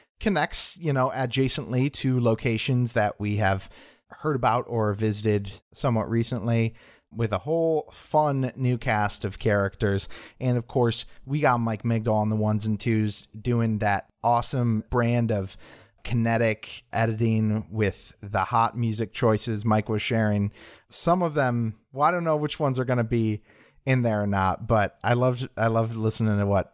Speech in English. There is no code.